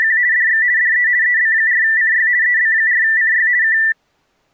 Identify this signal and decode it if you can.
RTTY (50 baud, 170 Hz shift), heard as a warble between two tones, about 1850 Hz centre. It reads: … DX DE EB4CY EB4CY K